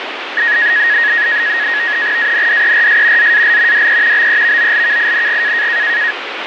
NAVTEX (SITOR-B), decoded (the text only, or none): ANDERS ZAL DE BEVOLKING